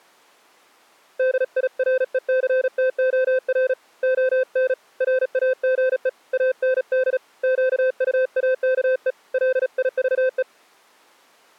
Morse code, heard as a keyed tone, hand-sent with a paddle, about 36 wpm, 520 Hz. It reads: DIRECTOR ON RAGE AND QUAKE LIVE